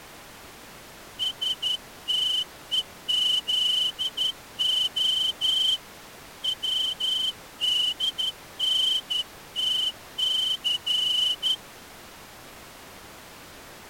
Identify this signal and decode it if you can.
Morse code, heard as a whistle, hand-sent with a straight key, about 11 wpm. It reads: STEZO WDNTC